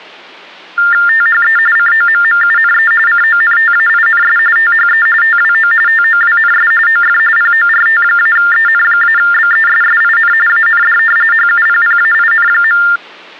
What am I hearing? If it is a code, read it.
TTY/TDD text telephone tones (45.45 baud Baudot), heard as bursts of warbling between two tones, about 400 Hz shift, 1600 Hz centre. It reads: THE COMMUNE CONTAINS THE TWO TOWNS OF PORT-EN-BESSIN AND HUPPAIN.